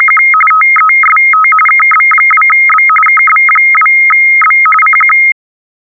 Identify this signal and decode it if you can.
RTTY (45.45 baud, 850 Hz shift), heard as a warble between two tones, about 1700 Hz centre. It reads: … TEST KB2B KB2B CQ